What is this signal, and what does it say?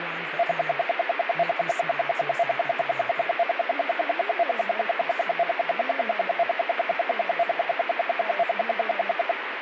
Radio time signal (RWM, Moscow), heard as ten pulses a second, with radio static and speech in English.